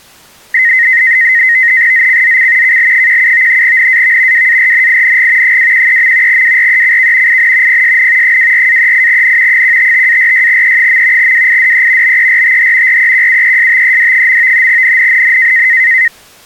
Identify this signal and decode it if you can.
NAVTEX (SITOR-B), 100 baud, 170 Hz shift, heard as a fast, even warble, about 1950 Hz centre. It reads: ZCZC KL17 NAV WARNING 213. WRECK IN PSN 24-38N 155-46E. WIDE BERTH REQUESTED. NNNN